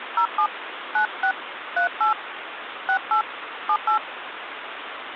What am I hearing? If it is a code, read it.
DTMF, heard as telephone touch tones, dialled by hand, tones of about 100 ms, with phone line noise. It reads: 07 96 38 68 78